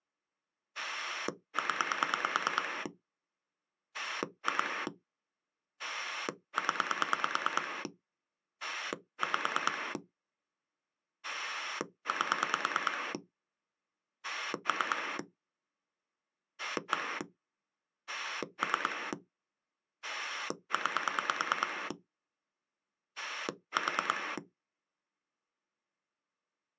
Pulse dialling, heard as a rotary dial, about 9 pulses a second. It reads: 0 2 0 5 8 3 1 3 9 4